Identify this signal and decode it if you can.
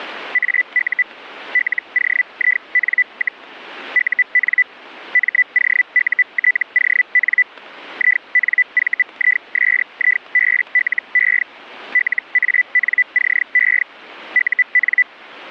Hellschreiber (Feld-Hell, 122.5 baud), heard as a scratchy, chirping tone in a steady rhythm, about 2000 Hz. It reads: AU LOIN, UN MOUTON INVISIBLE LANCE UN